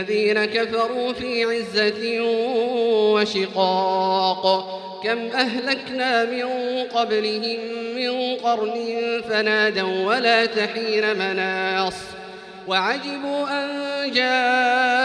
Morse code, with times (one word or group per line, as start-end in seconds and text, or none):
none